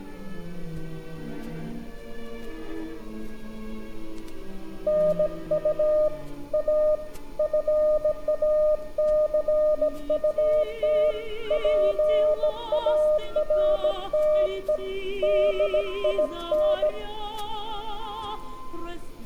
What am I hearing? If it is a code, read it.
Morse code, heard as a keyed tone, hand-sent with a bug key, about 17 wpm, 610 Hz, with room echo. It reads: NU A FACUT PARTE DIN